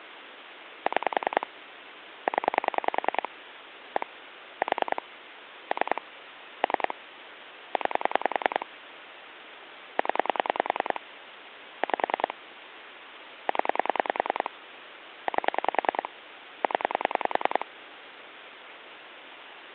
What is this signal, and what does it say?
Pulse dialling, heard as clicks on a phone line, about 10 pulses a second, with phone line noise. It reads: 6 0 1 4 3 3 9 0 5 0 8 0